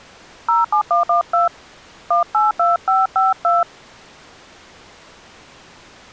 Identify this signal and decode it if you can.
DTMF, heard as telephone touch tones, dialled by hand, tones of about 140 ms. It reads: 07112 182552